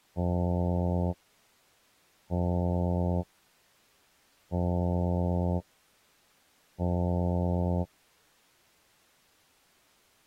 Ship horn signal, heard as a ship's horn, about 90 Hz. 4 short. At sea: a pilot vessel's identity signal in fog.